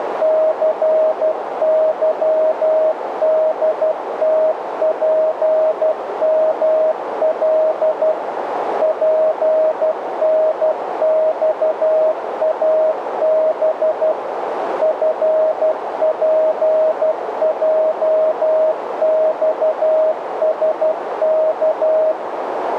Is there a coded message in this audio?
Yes: Morse code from 0.2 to 22.2 s, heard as a keyed tone, machine-sent, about 12 wpm, 630 Hz, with radio static and a narrow filter. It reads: CYDTPML PNXAB FPJXSK